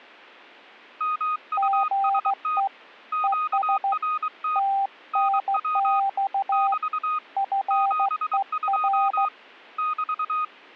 Morse code, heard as two keyed tones. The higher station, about 23 wpm, 1240 Hz: MUST QRT NW <BT> 72 <BT>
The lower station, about 15 wpm, 790 Hz: GE ES TNX FER